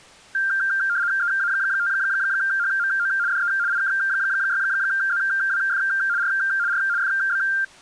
RTTY (75 baud, 170 Hz shift), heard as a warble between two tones, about 1490 Hz centre. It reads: EA5HMO DE IK6ZWF R R FB